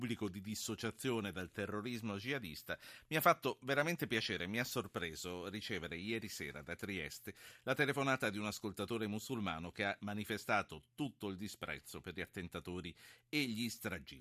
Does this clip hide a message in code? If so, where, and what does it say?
No, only speech in Italian.